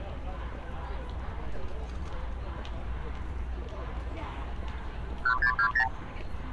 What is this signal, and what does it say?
Multi-frequency trunk signalling (R2, with the far end's replies), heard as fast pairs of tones, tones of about 80 ms, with street noise. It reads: 1620